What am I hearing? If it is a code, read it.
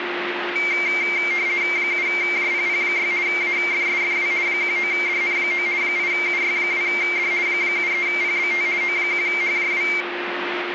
RTTY (50 baud, 170 Hz shift), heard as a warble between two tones, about 2200 Hz centre, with radio static and a steady whistle near 350 Hz. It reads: 7JPP6 AFSFW 19DN9 8UY2D 73PBT O1HJW